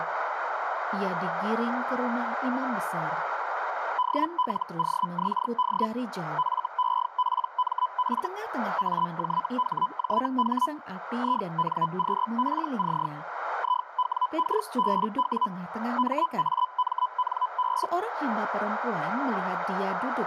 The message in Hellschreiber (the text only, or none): DLOXD FEPMF AJHJH INQPC IWKBW MAMNB